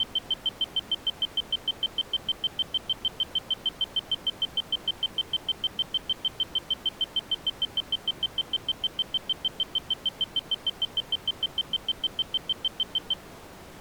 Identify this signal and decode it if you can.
Evenly repeated beeps. There is no code.